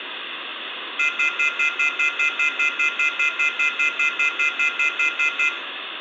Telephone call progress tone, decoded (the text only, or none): off-hook warning tone